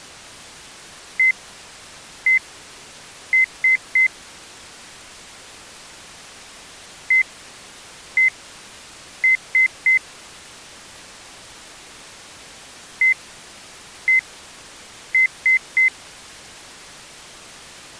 Beep code, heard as beeps, played three times, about 2050 Hz. 1-1-3. In Phoenix BIOS tables: CMOS read or write failure.